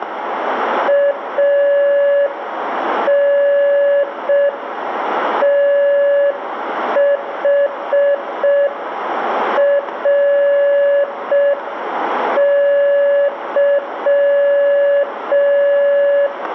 Morse code, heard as a keyed tone, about 5 wpm, 570 Hz, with radio static and room echo. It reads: ANTHRY